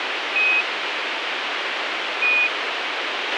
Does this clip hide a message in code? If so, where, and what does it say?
Yes: Quindar tones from 0.4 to 2.5 s, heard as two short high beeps, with radio hiss and a squelch burst at the end.